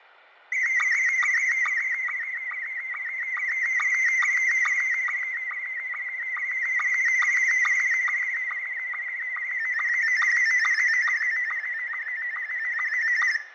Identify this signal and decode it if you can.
SSTV (slow-scan television), Scottie S1, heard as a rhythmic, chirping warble, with radio static, fading and room echo.